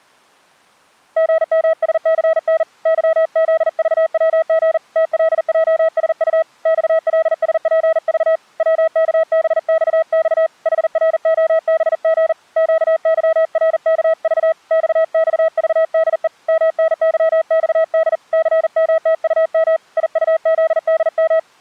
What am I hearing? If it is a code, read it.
Morse code, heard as a keyed tone, hand-sent with a paddle, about 40 wpm, 650 Hz. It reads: GMSCN YZVWG TLJSU XLSPV WKBXX HROBG QYRKV XXVDE MNYXD CMTUM IUZDM